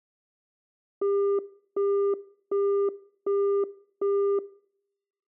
Telephone call progress tone (as in the UK, Australia and similar networks), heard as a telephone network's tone, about 400 Hz, 0.375 s on and 0.375 s off, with room echo. Busy tone.